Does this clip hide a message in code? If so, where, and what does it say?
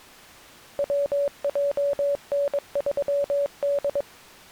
Yes: Morse code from 0.7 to 4.1 s, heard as a keyed tone, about 22 wpm, 570 Hz. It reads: WJN3D